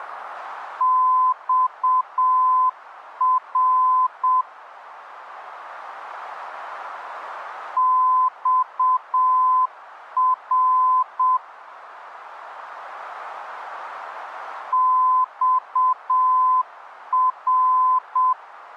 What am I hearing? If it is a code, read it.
Morse code, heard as a keyed tone, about 7 wpm, 1020 Hz. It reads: XR XR XR